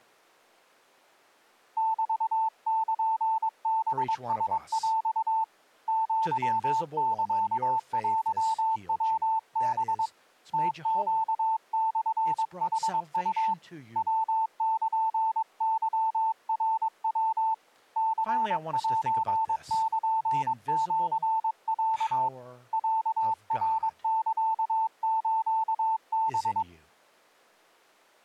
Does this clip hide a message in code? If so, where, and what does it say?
Yes: Morse code (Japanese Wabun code) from 1.7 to 26.7 s, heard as a keyed tone, hand-sent with a paddle, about 22 wpm, 890 Hz, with speech in English. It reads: メルハラヰ アサテヤハ ムネモヌウ ヤルケナヤ ニセルシロ ロナサスハ